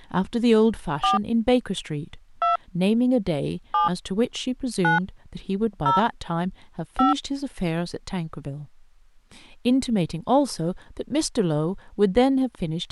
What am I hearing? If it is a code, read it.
DTMF, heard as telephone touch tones, dialled by hand, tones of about 140 ms, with speech in English. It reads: 4 2 7 9 0 5